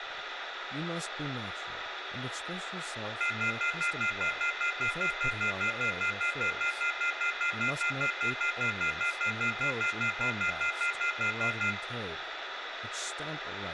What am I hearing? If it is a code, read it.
Telephone call progress tone (North American plan), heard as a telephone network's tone, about 1400, 2050, 2450, 2600 Hz, 0.1 s on and 0.1 s off, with phone line noise, room echo and speech in English. Off-hook warning tone.